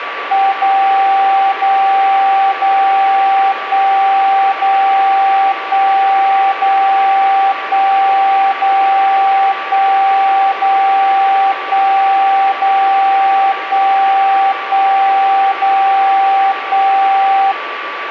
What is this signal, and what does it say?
Radio time signal (DCF77), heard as a tone whose level steps once a second, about 780 Hz, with radio static and a steady whistle near 1160 Hz. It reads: 0 0 0 1 0 1 0 1 0 1 0 1 0 1 1 0 1